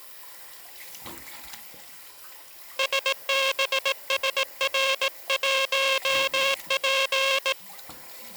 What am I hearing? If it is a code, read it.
Morse code, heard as a buzzer, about 18 wpm, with the noise of a restroom. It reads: SBSR1P